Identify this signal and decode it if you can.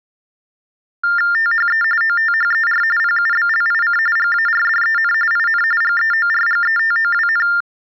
TTY/TDD text telephone tones (45.45 baud Baudot), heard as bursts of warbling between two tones, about 400 Hz shift, 1600 Hz centre. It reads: THE OTHER PUBLIC GARDEN IN GEORGETOWN